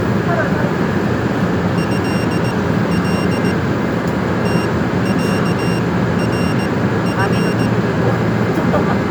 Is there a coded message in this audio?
Yes: Morse code (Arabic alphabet) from 1.7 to 7.7 s, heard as a high beeper, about 18 wpm, spaced as for 13 wpm, 2750 Hz, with the noise inside a subway train. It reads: هل تعرف